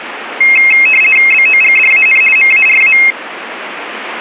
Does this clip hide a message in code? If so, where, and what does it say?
Yes: RTTY (50 baud, 450 Hz shift) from 0.4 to 3.1 s, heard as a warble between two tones, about 2350 Hz centre. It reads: BOGDAN MARA